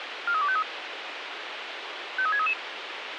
Five-tone selective call (ZVEI), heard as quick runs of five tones, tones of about 70 ms, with radio hiss. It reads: 43253 53633